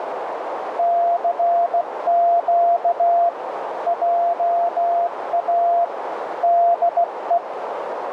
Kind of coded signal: Morse code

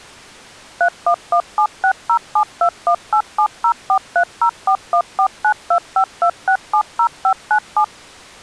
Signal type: DTMF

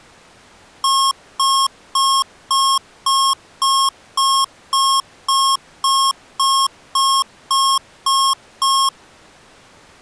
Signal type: none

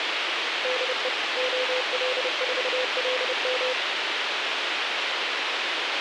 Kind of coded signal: Morse code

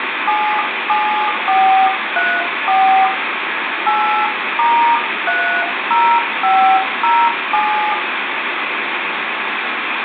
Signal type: DTMF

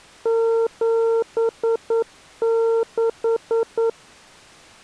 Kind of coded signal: Morse code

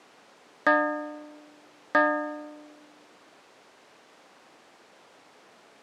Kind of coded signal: clock strike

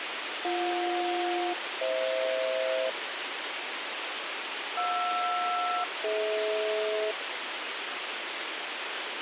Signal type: aircraft SELCAL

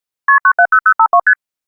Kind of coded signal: multi-frequency trunk signalling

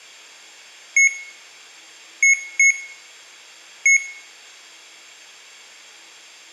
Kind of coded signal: beep code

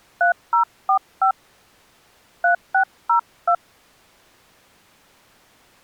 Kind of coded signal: DTMF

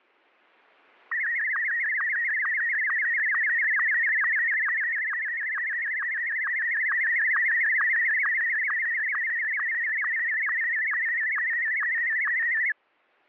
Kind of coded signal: SSTV (slow-scan television)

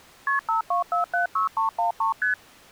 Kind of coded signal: multi-frequency trunk signalling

